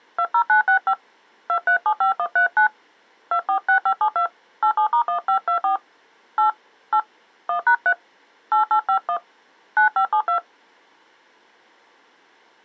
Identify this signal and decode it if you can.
DTMF, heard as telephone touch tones, dialled by hand, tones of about 90 ms. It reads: 20965 2375139 246572 87*1524 8 8 1#3 8851 9572